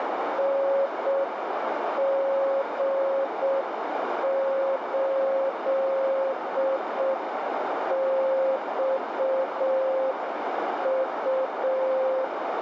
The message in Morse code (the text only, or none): NG8XU